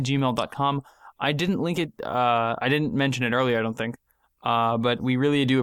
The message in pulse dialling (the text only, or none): none